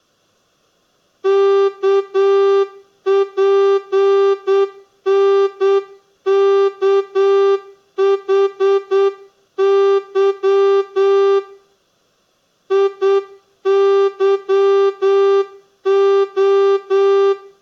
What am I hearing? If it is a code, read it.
Morse code, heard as a horn, hand-sent with a straight key, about 8 wpm, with room echo. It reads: KPNKHY IYO